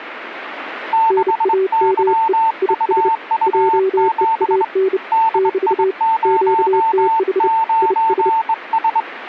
Morse code, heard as two keyed tones, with radio static. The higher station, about 23 wpm, 900 Hz: 6YUU7 DI09S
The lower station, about 30 wpm, 380 Hz: NAME IS JEAN <BT> QTH IS